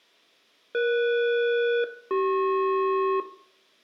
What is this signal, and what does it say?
Aircraft SELCAL, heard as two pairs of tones, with room echo. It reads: ES-CP